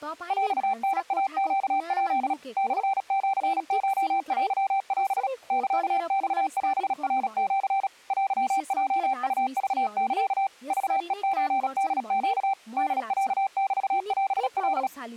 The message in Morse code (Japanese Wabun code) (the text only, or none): ヰタイネヱ モシコテオ サマオナシ テヲウクサ クヘソホネ ホロメオカ